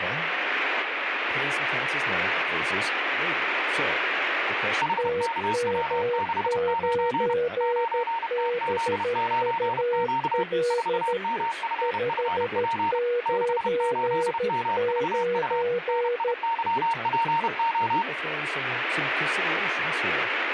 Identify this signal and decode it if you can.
Morse code, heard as two keyed tones, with radio static and speech in English. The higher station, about 31 wpm, 920 Hz: HKW69 9TZ9Q 4MFFP 68MVU NIYPO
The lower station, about 13 wpm, 480 Hz: TM9BUL 599